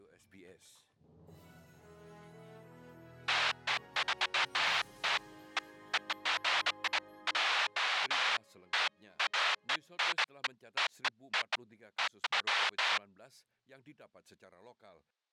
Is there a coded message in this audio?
No, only bursts of noise.